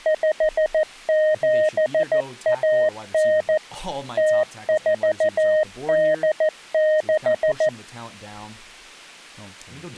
Morse code (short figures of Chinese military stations), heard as a keyed tone, machine-sent, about 14 wpm, 620 Hz, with speech in English. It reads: 5719 0486